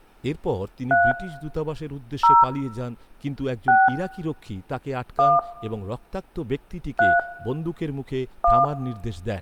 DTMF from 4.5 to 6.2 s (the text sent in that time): 1